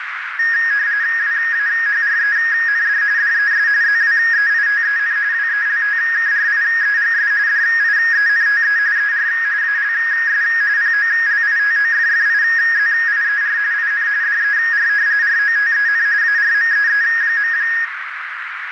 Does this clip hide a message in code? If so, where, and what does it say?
Yes: RTTY (45.45 baud, 170 Hz shift) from 0.4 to 17.8 s, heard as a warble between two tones, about 1750 Hz centre, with radio static and a narrow filter. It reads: WAHREND DES ZWEITEN WELTKRIEGS DIENTE ER ALS POLITOFFIZIER IN DER ROTEN ARMEE.